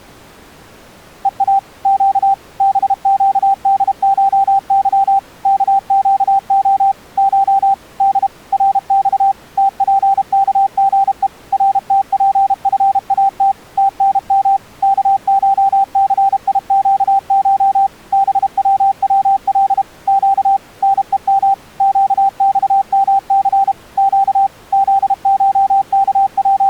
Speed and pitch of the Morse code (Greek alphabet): 32 wpm, 780 Hz

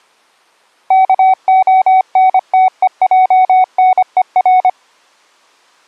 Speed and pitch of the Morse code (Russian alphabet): 25 wpm, 750 Hz

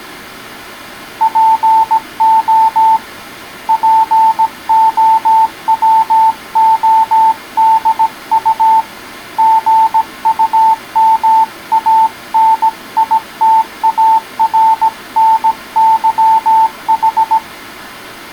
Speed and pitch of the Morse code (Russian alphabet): 17 wpm, 890 Hz

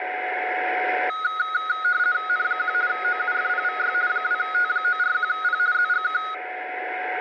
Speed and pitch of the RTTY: 50 baud, 170 Hz shift, 1360 Hz centre

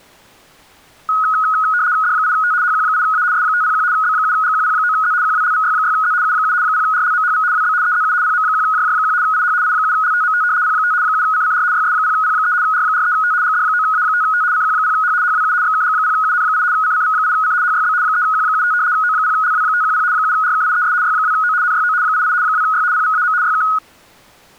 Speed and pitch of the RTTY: 75 baud, 170 Hz shift, 1360 Hz centre

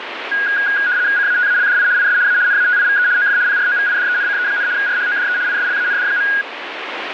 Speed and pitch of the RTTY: 75 baud, 170 Hz shift, 1550 Hz centre

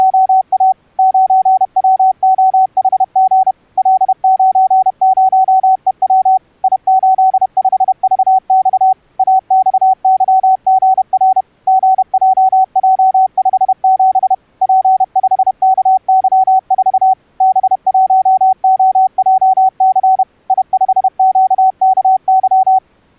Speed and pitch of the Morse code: 31 wpm, 760 Hz

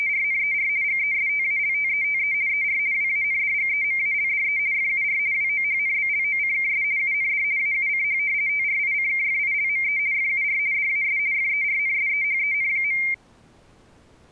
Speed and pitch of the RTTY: 50 baud, 170 Hz shift, 2200 Hz centre

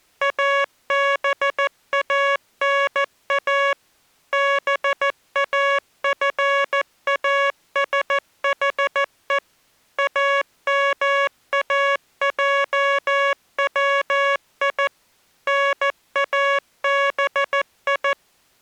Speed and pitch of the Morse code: 14 wpm, 560 Hz

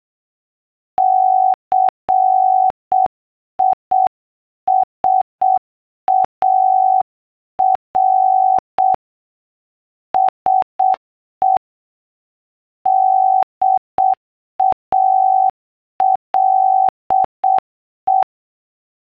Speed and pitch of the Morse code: 7 wpm, 760 Hz

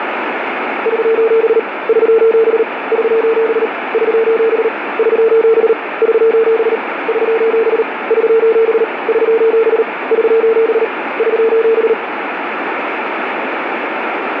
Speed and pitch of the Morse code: 38 wpm, 450 Hz

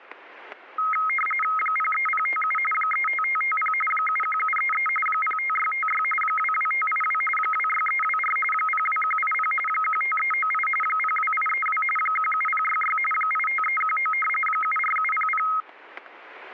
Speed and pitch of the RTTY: 45.45 baud, 850 Hz shift, 1700 Hz centre

